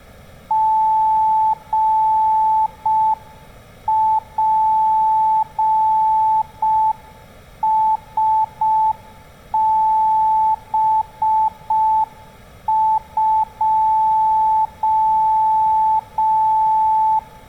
Morse code, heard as a keyed tone, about 5 wpm, 880 Hz, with room echo. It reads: GPSB2